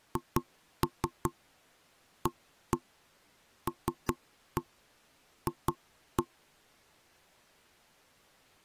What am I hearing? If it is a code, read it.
Tap code, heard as knocks on wood, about 5 knocks a second. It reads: HALF